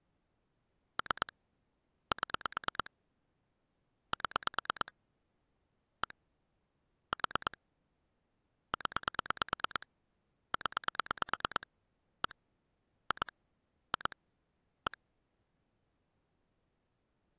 Pulse dialling, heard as clicks on a phone line, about 9 pulses a second. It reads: 3 7 7 1 4 0 0 1 2 2 1